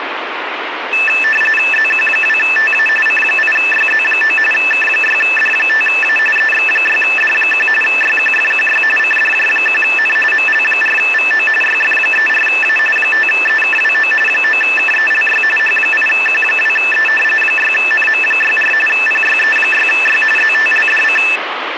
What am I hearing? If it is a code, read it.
RTTY (45.45 baud, 850 Hz shift), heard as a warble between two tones, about 2200 Hz centre, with radio static. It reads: ZQ2TA C8YZ9 K6D5A EX6D1 YQFQY CDJ1N ML4VO YF34A 5EKWO 9KELY H8Q2E 6NM64 PYE6Y ZTLDC